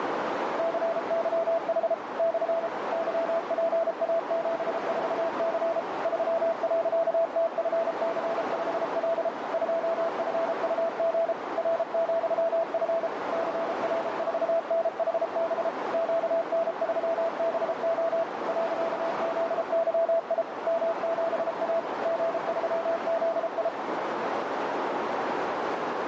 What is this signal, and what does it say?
Morse code, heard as a keyed tone, machine-sent, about 33 wpm, 660 Hz, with heavy radio static and a narrow filter. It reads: CYH / YPA74C 3.TFC5L 2FUG R,F CR4NHB QN3BO .ZYI M7A G3ZI